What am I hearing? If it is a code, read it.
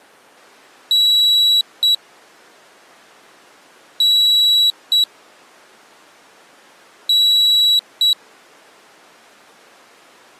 Beep code, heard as a piezo beeper, played three times, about 3900 Hz. 1 long, 1 short. In IBM BIOS tables: system board problem.